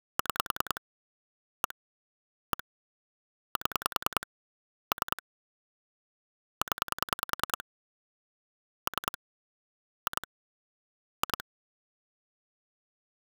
Pulse dialling, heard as clicks on a phone line, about 10 pulses a second. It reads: 6 1 1 7 3 0 3 2 2